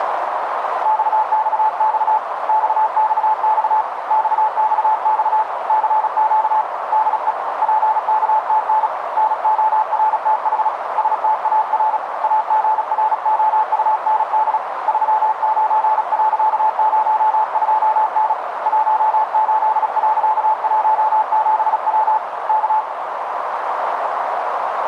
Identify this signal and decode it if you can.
Morse code, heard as a keyed tone, hand-sent with a paddle, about 36 wpm, 870 Hz, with radio static and a narrow filter. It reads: XXX XXX XXX CQ DE PKTN NORTH STAR AGROUND 39.02N 18.17W K